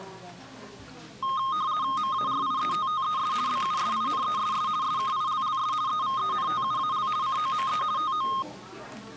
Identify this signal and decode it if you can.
RTTY (50 baud, 170 Hz shift), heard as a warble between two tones, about 1150 Hz centre, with the noise of a crowd indoors. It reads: MARIETTES BUSINESS SKILLS EVENTUAL COME TO